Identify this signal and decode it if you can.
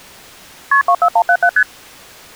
Multi-frequency trunk signalling (R1, as on North American trunks), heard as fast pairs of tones, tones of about 70 ms. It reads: KP 24177 ST